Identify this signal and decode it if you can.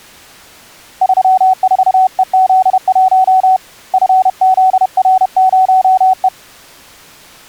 Morse code, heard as a keyed tone, hand-sent with a paddle, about 31 wpm, 750 Hz. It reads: 34EZ1 FZR0E